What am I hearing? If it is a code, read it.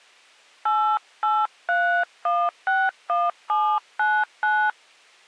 DTMF, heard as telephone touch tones, dialled by hand, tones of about 270 ms. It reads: 883161799